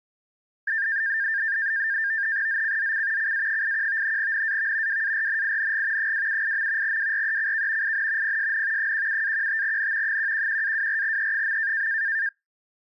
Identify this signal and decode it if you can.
NAVTEX (SITOR-B), 100 baud, 170 Hz shift, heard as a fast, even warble, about 1700 Hz centre. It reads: ZCZC CA81 NAV WARNING 278. WRECK IN PSN 17-15N 111-24E.